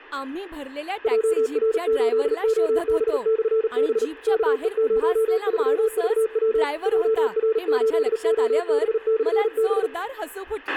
Morse code, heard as a keyed tone, machine-sent, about 38 wpm, 440 Hz, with a squelch burst at the end and speech in Marathi. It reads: JR8OB/B KE03VW JR8OB/B